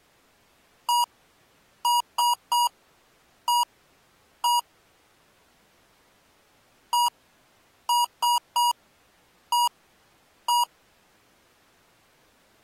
Beep code, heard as beeps from a small speaker, played twice, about 960 Hz. 1-3-1-1. In Phoenix BIOS tables: memory refresh test failure.